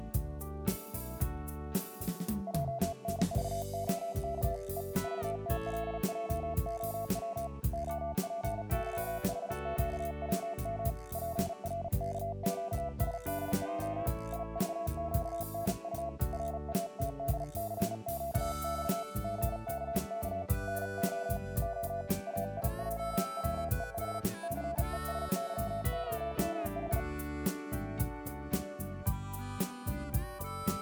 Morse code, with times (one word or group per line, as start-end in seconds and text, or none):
2.5-4.6 JNVOK
4.8-4.8 E
5.0-7.5 VTLJOW
7.7-10.9 OPYHQWM
11.1-14.1 PRKQSDJ
14.3-16.1 IVQNU
16.3-19.0 RATDCQX
19.2-20.4 GKK
20.7-21.4 NO
21.6-22.0 O
22.3-24.2 AIJWEH
24.4-27.0 CESYOMH